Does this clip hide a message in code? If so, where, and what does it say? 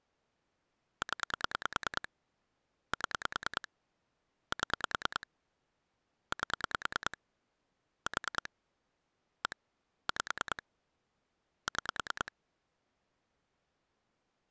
Yes: pulse dialling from 1.0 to 12.3 s, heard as clicks on a phone line, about 9 pulses a second. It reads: 0 7 7 8 4 1 5 6